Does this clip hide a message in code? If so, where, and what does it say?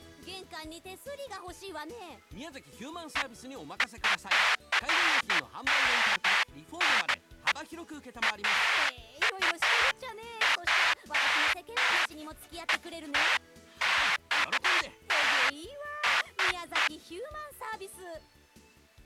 No, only bursts of noise.